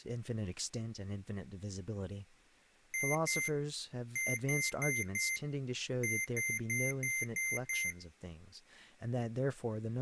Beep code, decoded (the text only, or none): 2-4-6